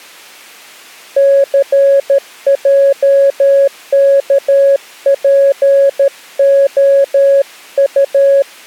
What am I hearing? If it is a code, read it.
Morse code, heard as a keyed tone, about 13 wpm, 550 Hz. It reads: CJKPOU